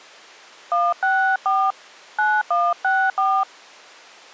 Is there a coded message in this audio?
Yes: DTMF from 0.7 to 3.4 s, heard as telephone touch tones, dialled by hand, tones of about 230 ms. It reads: 164 9164